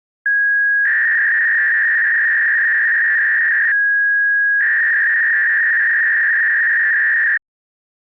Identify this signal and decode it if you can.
300-baud modem data (V.21 tones), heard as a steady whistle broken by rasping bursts, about 300 baud, 200 Hz shift.